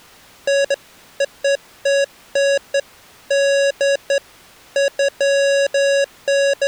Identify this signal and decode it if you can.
Beeps of irregular length. There is no code.